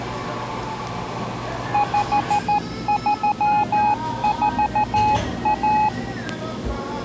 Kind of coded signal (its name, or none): Morse code